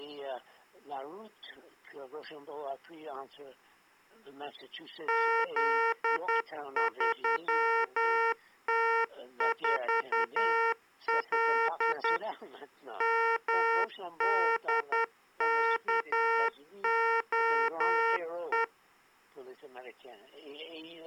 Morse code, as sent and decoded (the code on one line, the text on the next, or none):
--.. ...-- - ....- .-.. / -- -.. -.- --- .
Z3T4L MDKOE